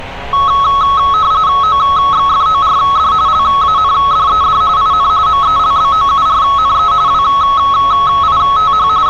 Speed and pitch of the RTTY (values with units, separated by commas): 45.45 baud, 170 Hz shift, 1200 Hz centre